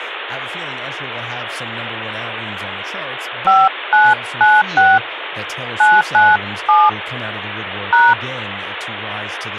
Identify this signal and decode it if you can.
DTMF, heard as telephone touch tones, dialled by hand, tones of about 210 ms, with phone line noise and speech in English. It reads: 5996 997 #